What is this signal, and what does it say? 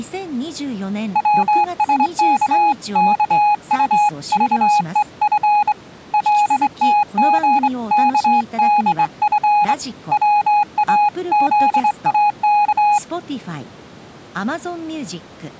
Morse code (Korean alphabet), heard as a keyed tone, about 23 wpm, 830 Hz, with speech in Japanese. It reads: 병이란 것은 보통